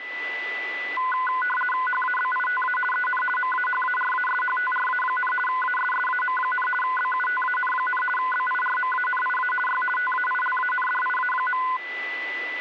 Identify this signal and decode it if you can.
RTTY (50 baud, 450 Hz shift), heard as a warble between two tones, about 1250 Hz centre, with a steady whistle near 1990 Hz. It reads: HABITA EN MAHARASHTRA, ASSAM, BUTAN, BIRMANIA Y TAILANDIA.